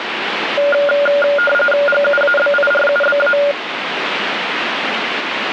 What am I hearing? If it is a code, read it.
RTTY (45.45 baud, 850 Hz shift), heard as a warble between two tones, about 1000 Hz centre, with radio static. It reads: GUABIRUBA